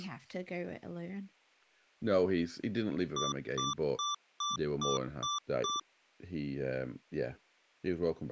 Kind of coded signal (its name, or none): beep code